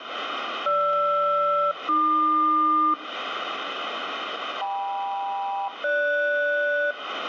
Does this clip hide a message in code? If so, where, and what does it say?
Yes: aircraft SELCAL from 0.7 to 6.9 s, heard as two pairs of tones, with radio static and room echo. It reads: GR-AQ KM-GS